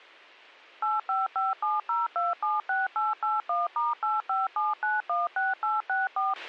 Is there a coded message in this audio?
Yes: DTMF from 0.8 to 6.3 s, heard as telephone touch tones, dialled by machine, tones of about 180 ms, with a squelch burst at the end. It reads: 85570276881*857916864